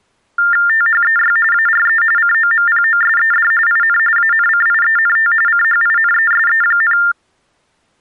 TTY/TDD text telephone tones (45.45 baud Baudot), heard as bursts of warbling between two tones, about 400 Hz shift, 1600 Hz centre. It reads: THEY ARE COMPOSED IN ANCIENT CHINESE,